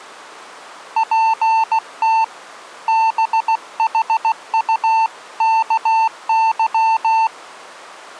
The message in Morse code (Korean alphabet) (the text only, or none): 저 뒤에